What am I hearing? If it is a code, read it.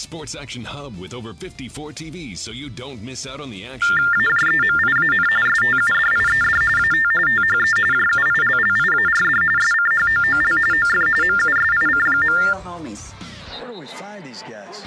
TTY/TDD text telephone tones (45.45 baud Baudot), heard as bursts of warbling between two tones, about 400 Hz shift, 1600 Hz centre. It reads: AJEMIAN STUDIED AT THE JUILLIARD SCHOOL OF MUSIC.